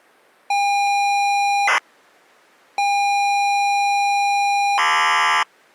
ZX Spectrum tape loading, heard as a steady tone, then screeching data.